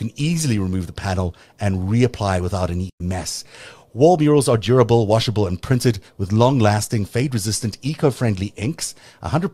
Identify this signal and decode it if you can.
Speech in English. There is no code.